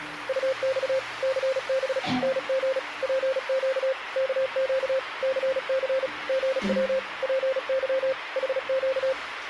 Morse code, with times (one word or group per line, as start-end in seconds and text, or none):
0.3-1.0 UX
1.2-2.0 CB
2.2-2.8 NG
3.0-3.9 PQ
4.2-5.0 KQ
5.2-6.1 CC
6.3-7.0 GW
7.2-8.1 PY
8.4-9.1 HQ